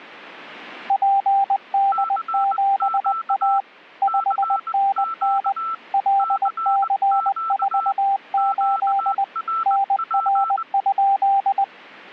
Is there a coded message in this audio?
Yes: Morse code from 0.8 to 11.7 s, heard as two keyed tones. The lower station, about 20 wpm, 790 Hz: PD7A 5NN LC48 NR?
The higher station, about 20 wpm, 1330 Hz: CQ CQ CQ QRP